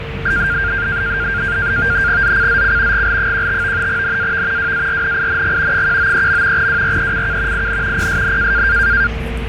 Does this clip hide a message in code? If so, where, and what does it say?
Yes: NAVTEX (SITOR-B), 100 baud, 170 Hz shift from 0.3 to 9.1 s, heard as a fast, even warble, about 1500 Hz centre, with radio static, a steady whistle near 450 Hz and the noise inside a bus. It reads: ZCZC GL15 NAV WARNING 193. WRECK IN PSN